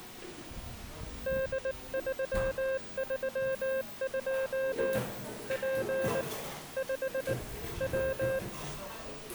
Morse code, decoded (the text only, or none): D332 P 5 W